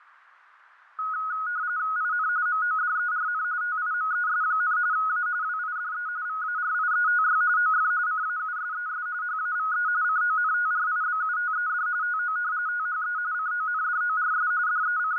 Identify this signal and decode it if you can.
RTTY (45.45 baud, 170 Hz shift), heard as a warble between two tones, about 1360 Hz centre, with fading. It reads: IN MODERN TIMES, A WIDE VARIETY OF CAUSES HAVE CONTRIBUTED TO THE CONDORS …